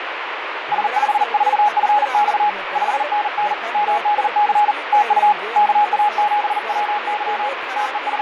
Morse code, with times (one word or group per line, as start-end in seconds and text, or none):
0.7-2.5 S54FX
2.8-3.5 5NN
3.7-4.7 MDC
4.9-5.3 TU
5.6-7.5 KA7WY
7.8-8.2 …